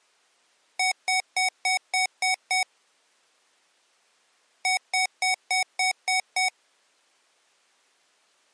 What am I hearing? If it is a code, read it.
Beep code, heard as beeps from a small speaker, played twice, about 750 Hz. 7 short. In AMI BIOS tables: virtual mode exception error; in Dell tables: processor failure.